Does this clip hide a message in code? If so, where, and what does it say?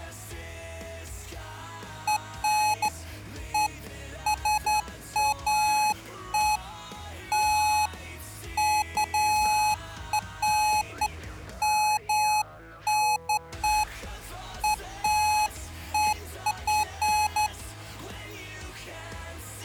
No, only beeps of irregular length.